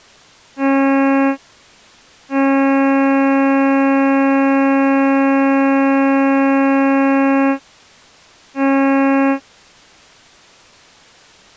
Ship horn signal, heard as a ship's horn, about 270 Hz. 1 short, 1 long, 1 short. At sea: a vessel at anchor warns of its position.